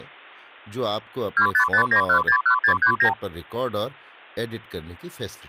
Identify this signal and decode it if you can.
Multi-frequency trunk signalling (R2, with the far end's replies), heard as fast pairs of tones, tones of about 90 ms, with speech in Urdu. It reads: 2559161639